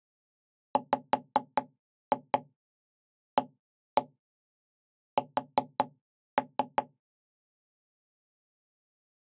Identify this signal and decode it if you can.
Tap code, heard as knocks on wood, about 5 knocks a second. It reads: WAS